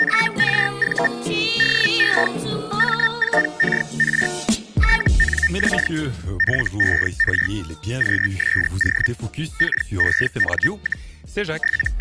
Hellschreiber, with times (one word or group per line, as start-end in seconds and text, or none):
0.0-1.1 …
1.6-2.3 DE
2.8-4.3 M4KR
4.8-5.9 TNX
6.4-7.5 FER
8.0-9.1 QSO
9.6-11.1 KEN,
11.6-12.0 …